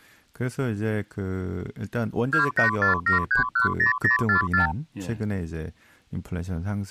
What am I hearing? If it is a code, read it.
Multi-frequency trunk signalling (R2, with the far end's replies), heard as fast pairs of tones, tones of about 120 ms, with speech in Korean. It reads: 2847310044